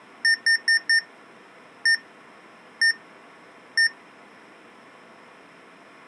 Beep code, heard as beeps from a small speaker, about 1800 Hz. 4-1-1-1.